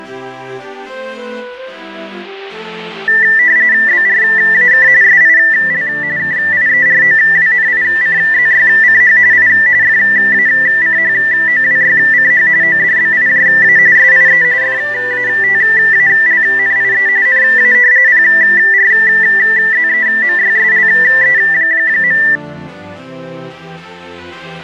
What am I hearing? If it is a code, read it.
RTTY (45.45 baud, 170 Hz shift), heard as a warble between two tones, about 1850 Hz centre. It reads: BRAK SIL KIEROWNICZYCH I FACHOWYCH ODBIJA SIE FATALNIE NA PRZEMYSLE.